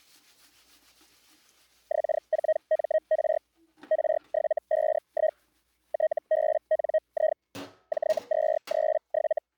Hellschreiber (Feld-Hell, 122.5 baud), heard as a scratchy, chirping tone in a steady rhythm, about 630 Hz, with kitchen noise. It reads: X4MR R751 TBNI J237